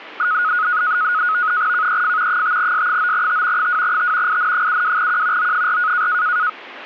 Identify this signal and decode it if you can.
NAVTEX (SITOR-B), 100 baud, 170 Hz shift, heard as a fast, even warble, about 1360 Hz centre. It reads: KEF 5S9T 2T IN72Q O4